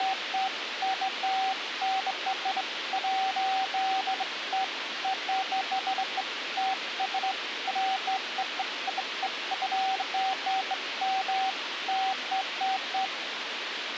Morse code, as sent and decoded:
none

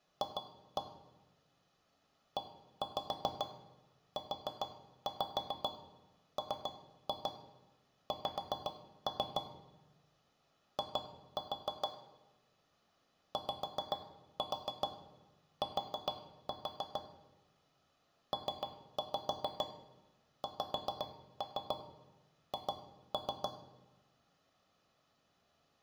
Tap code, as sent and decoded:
2-1 / 1-5 4-5 3-2 5-3 / 2-4 / 5-4 4-4 / 3-5 5-3 2-3
F EUMX I YT PXH

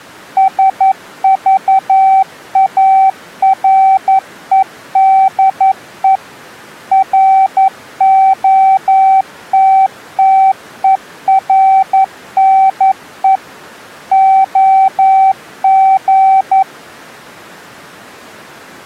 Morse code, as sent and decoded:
... ...- .- .-. . -.. . / .-. --- - - . .-. -. . / --- --.
SVAREDE ROTTERNE OG

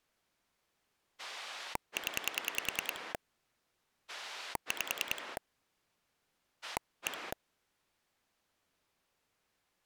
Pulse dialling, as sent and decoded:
10 / 5 / 1
0 5 1

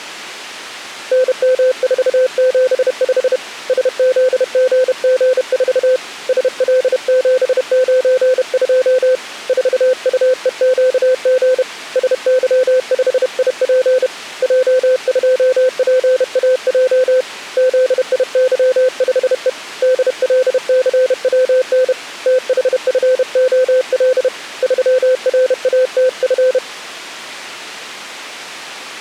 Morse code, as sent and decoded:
-. -- ....- --... ..... / ... --.. --. --. ....- / ... .-.. --... ----. ..--- / ....- ..- . --.- --. / ... -.-- ..... .. .--. / .--- ..--- .--. .- .--- / --.. .. -.-- ..... . / -.. .-.. -.-. .-- -. / - .... ..-. --- .-.. / ...-- .-. .- - ..-.
NM475 SZGG4 SL792 4UEQG SY5IP J2PAJ ZIY5E DLCWN THFOL 3RATF

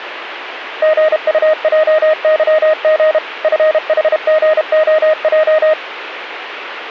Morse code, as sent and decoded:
--. ..- .--- -.-- --. / ..-. .... --. --- .---
GUJYG FHGOJ

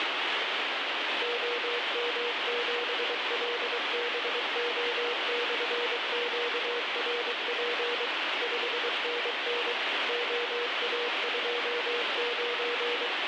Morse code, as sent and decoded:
--- -- --... .-.. -... --- -..-. --.- .-. .--. / ..... -. -. / --- .- ..--- ----.
OM7LBO/QRP 5NN OA29

